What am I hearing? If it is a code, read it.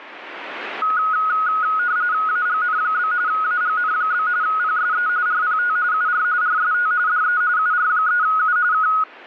RTTY (45.45 baud, 170 Hz shift), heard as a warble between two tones, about 1360 Hz centre, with radio static. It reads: AGN? AGN? PSE RPT UR RST DE UR3U K